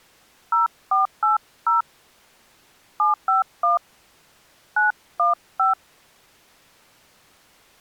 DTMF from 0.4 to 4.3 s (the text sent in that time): 0480 751